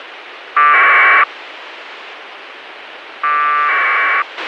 Packet radio (AX.25, as in APRS), 1200 baud, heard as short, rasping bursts, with radio hiss and a squelch burst at the end.